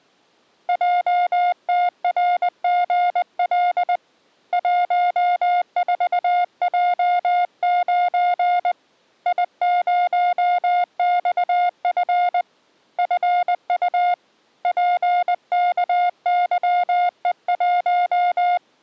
Morse code, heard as a keyed tone, hand-sent with a paddle, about 20 wpm, 710 Hz. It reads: JTRGL 14J9 I0XF FU PKYE1